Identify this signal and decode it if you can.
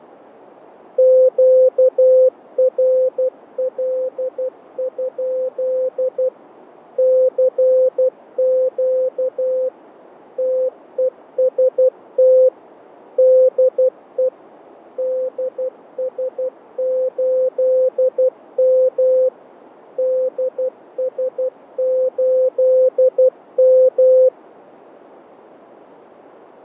Morse code, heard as a keyed tone, machine-sent, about 12 wpm, 520 Hz, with radio static and fading. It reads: QRL? CQ TEST DE DS8M DS8M